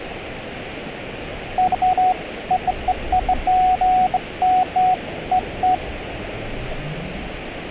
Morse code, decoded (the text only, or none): none